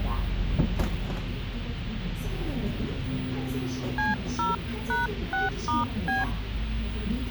DTMF, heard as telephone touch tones, dialled by hand, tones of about 160 ms, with a squelch burst at the end and the noise inside a bus. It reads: C0#6*B